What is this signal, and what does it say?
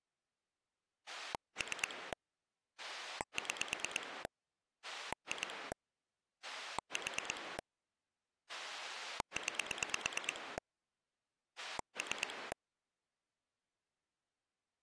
Pulse dialling, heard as a rotary dial, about 9 pulses a second. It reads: 3 6 2 4 9 3